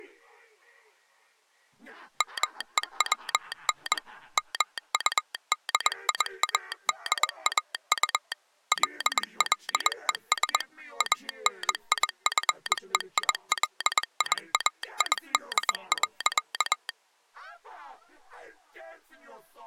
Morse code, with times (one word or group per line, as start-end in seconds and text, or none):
2.2-4.0 MEWN
4.4-8.3 MUDIADAU
8.7-10.6 LLES
11.0-16.9 ANIFEILIAID.